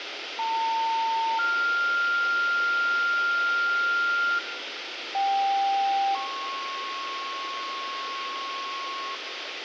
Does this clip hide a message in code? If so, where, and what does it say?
Yes: two-tone page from 0.4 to 9.1 s, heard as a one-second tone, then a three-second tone, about 900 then 1400 Hz, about 790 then 1090 Hz, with radio hiss and room echo.